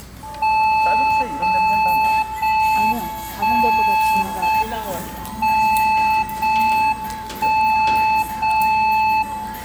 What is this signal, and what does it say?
Radio time signal (JJY), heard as a tone whose level steps once a second, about 870 Hz, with room echo and the noise of a restaurant. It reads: 0 0 1 0 M 0 1 0 0